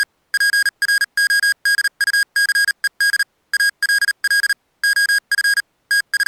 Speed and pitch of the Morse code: 38 wpm, spaced as for 33 wpm, 1650 Hz

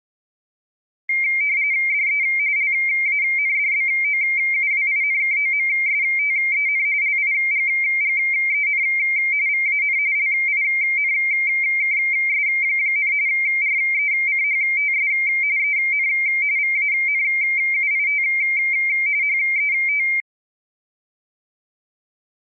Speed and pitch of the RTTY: 45.45 baud, 170 Hz shift, 2200 Hz centre

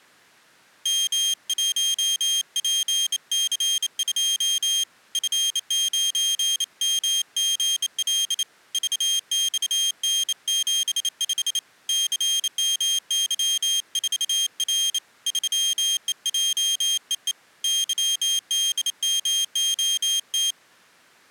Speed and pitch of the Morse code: 28 wpm, 3200 Hz

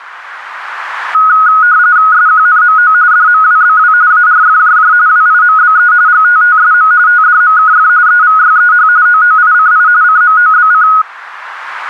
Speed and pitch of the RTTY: 45.45 baud, 170 Hz shift, 1360 Hz centre

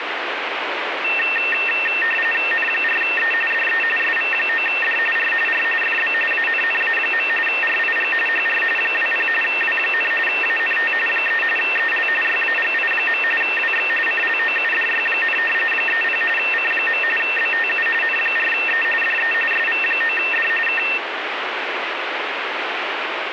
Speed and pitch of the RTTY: 45.45 baud, 850 Hz shift, 2250 Hz centre

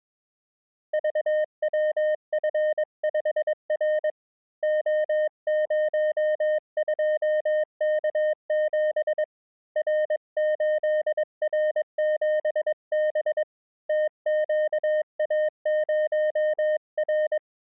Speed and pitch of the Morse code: 22 wpm, 610 Hz

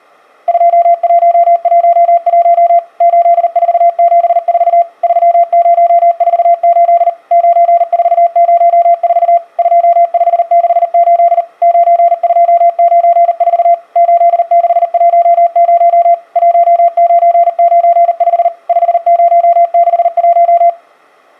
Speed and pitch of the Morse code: 39 wpm, 690 Hz

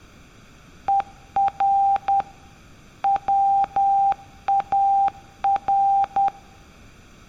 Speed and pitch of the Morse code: 10 wpm, 790 Hz

